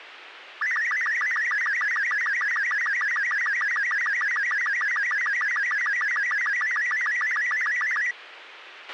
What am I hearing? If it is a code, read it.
SSTV (slow-scan television), Robot 36, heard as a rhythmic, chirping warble, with radio hiss and a squelch burst at the end.